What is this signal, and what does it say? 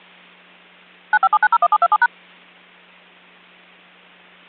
DTMF, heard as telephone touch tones, dialled by machine, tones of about 50 ms. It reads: 957901727#